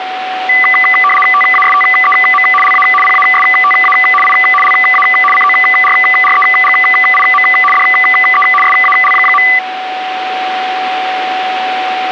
RTTY (75 baud, 850 Hz shift), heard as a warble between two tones, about 1600 Hz centre, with radio static and a steady whistle near 750 Hz. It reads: TASTEM LA PASTA I LA CORREGIM DE SAL.